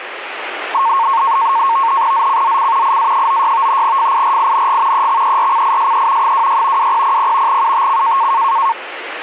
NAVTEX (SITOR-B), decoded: ZCZC IA96 FIRING EXERCISE 26 2000 UTC

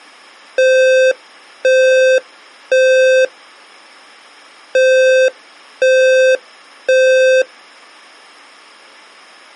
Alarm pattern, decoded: temporal three

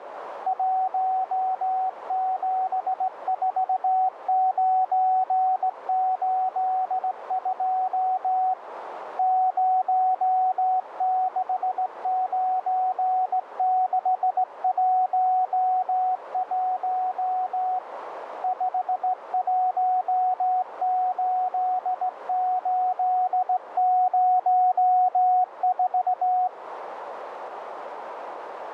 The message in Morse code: 174982 069611 518804

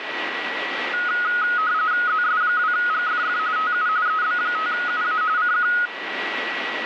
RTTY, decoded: ZS2GFF TU EB5UA CQ

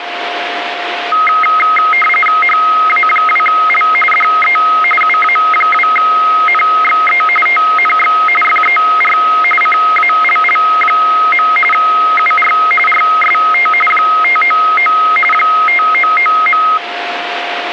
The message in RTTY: HA2L DE UA2NXE TNX FER CALL. UR RST 599 599.

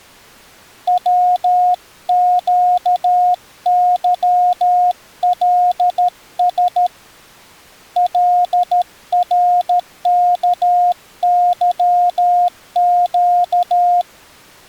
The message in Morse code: WQYLS LRKYQ

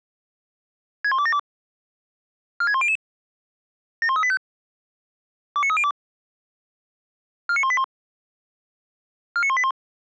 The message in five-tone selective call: 61272 46100 71385 29302 49181 49181

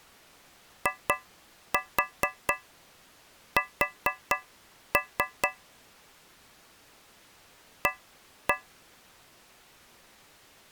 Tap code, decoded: IS A

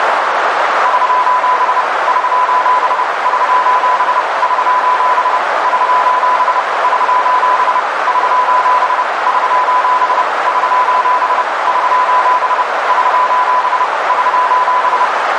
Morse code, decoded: <SOS> <SOS> <SOS> <SOS> <SOS> <SOS> <SOS> <SOS> <SOS> <SOS> <SOS> <SOS>

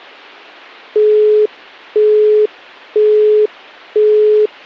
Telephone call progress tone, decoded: busy tone

